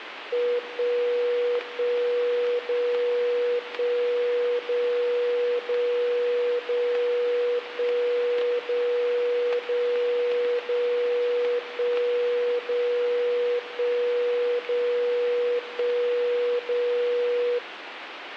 Radio time signal (DCF77), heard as a tone whose level steps once a second, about 480 Hz, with radio static and static crashes. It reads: 1 1 0 1 0 0 0 1 0 0 0 1 0 1 0 1 0